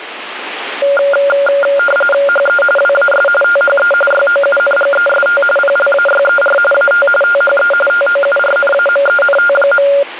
RTTY (45.45 baud, 850 Hz shift), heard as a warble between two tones, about 990 Hz centre, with radio static. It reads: HE WAS THE YOUNGEST PLAYER AT THE TOURNAMENT.